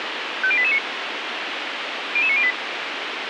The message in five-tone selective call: 50889 00908

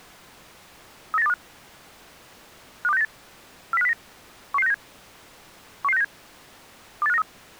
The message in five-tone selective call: 39825 52698 40509 11697 11697 28593

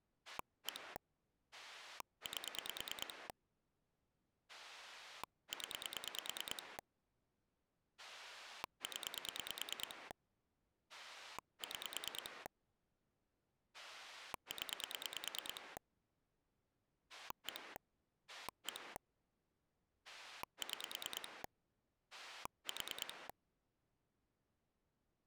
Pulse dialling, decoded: 1 8 0 0 6 0 1 1 6 4

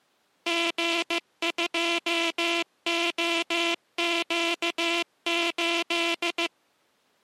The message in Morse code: G2OQ8

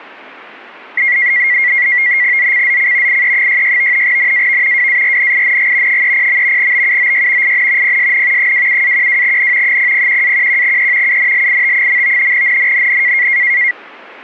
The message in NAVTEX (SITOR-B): ZCZC IE66 NAV WARNING 30. BUOY IN PSN 27-12N 001-11E UNLIT. NNNN

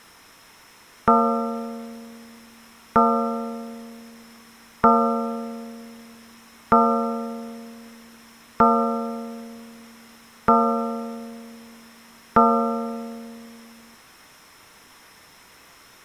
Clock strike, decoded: 7

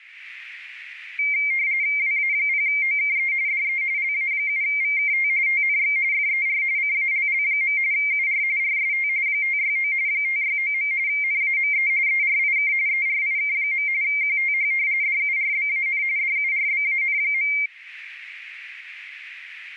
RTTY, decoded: WA0OKE DE LA7VKT TNX FER CALL. UR RST 569 569. NAME ERIK ERIK. QTH DURBAN DURBAN.

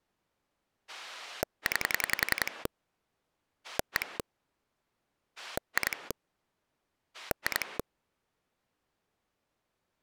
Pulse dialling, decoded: 9 1 2 2

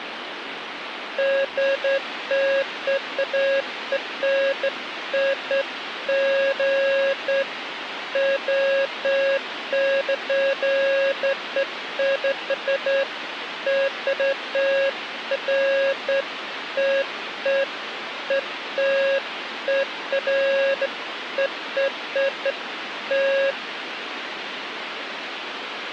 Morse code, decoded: none

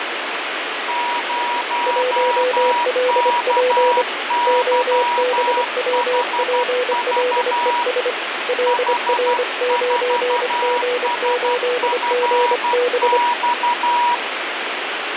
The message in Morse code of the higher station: 0KYHV H4SFX

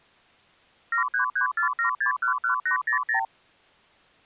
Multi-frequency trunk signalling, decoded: 73347611800

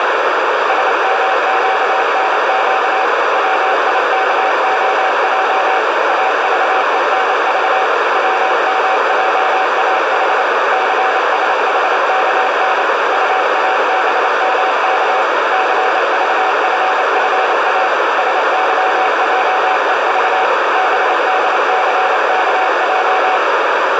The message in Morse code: SMQNQ WIKOJ AVENV WMJAH CSHKN UABMK CVFFA SYJEV BDCKJ

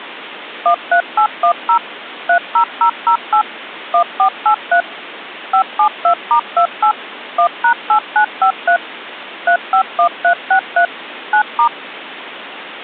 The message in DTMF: 13810 30008 1483 572*28 1#8953 351363 9*

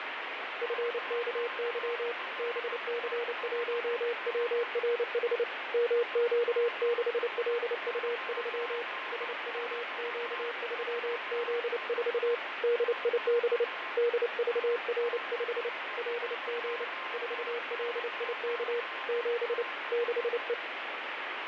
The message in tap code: none

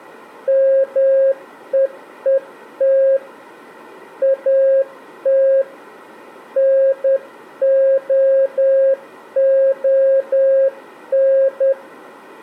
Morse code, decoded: MEET AT NOON

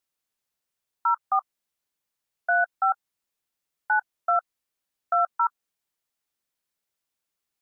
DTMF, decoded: 04 35 92 20

